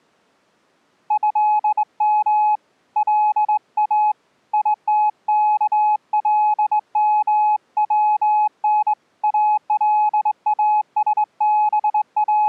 Morse code (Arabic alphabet), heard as a keyed tone, hand-sent with a straight key, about 21 wpm, 850 Hz. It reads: هم لا يتكلمون …